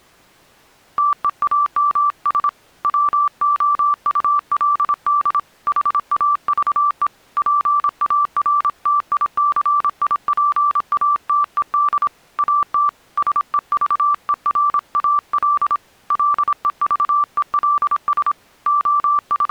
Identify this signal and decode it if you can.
Morse code, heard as a keyed tone, hand-sent with a paddle, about 26 wpm, 1170 Hz. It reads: TEAMS WOULD HAVE PARTICIPATED AT SEVERAL LEVELS …